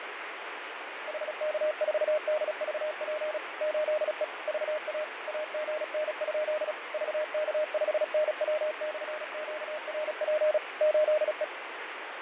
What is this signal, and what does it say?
Morse code, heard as a keyed tone, machine-sent, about 36 wpm, 610 Hz, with radio static and fading. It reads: HK4DVP 8E VA AGN? VK5NW/QRP 8E